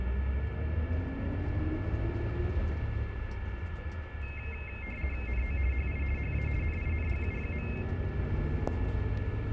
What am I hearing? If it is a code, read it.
RTTY (50 baud, 450 Hz shift), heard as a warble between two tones, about 2350 Hz centre, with radio static, a steady whistle near 1730 Hz and the noise inside a bus. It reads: NO HI HA NINGU.